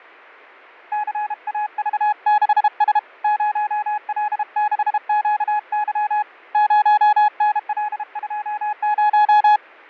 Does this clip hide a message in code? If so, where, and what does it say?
Yes: Morse code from 0.9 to 9.6 s, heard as a keyed tone, hand-sent with a paddle, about 32 wpm, 840 Hz, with fading. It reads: CAV6S 0L6QY 0NL20